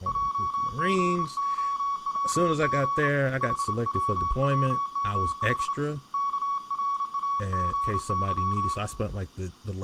Morse code, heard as a keyed tone, hand-sent with a straight key, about 28 wpm, 1120 Hz, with room echo and speech in English. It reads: JGOWG HWWMH KRAGY